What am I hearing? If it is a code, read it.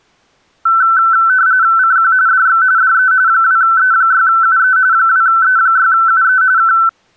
RTTY (45.45 baud, 170 Hz shift), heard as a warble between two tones, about 1430 Hz centre. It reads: CQ DX DE 2E6UE 2E6UE K